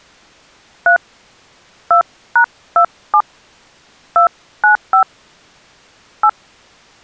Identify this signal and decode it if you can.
DTMF, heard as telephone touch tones, dialled by hand, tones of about 90 ms. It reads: 3 2#27 295 8